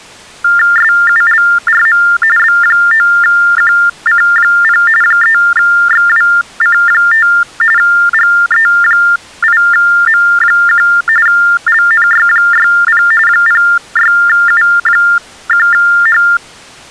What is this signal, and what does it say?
TTY/TDD text telephone tones (45.45 baud Baudot), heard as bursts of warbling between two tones, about 400 Hz shift, 1600 Hz centre. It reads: SULRM B9QC0 3XWC5 GE8M1 LNY60 06U1H